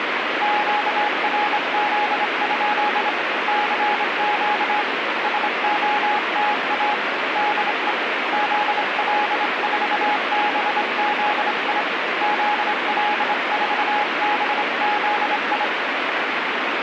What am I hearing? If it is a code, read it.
Morse code, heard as a keyed tone, hand-sent with a straight key, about 26 wpm, 840 Hz, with heavy radio static. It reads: QRZ? CQ SOTA DE ZL4BZI ZL4BZI